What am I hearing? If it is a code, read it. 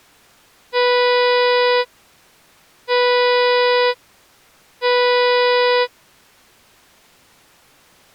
Ship horn signal, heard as a ship's horn, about 490 Hz. 3 short. At sea: I am operating astern propulsion.